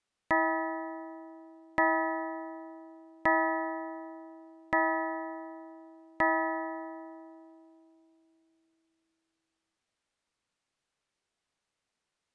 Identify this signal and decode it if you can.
Clock strike, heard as a bell. 5. Five o'clock.